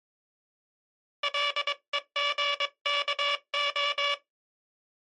Morse code (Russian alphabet), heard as a buzzer, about 22 wpm. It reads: ЛЕГКО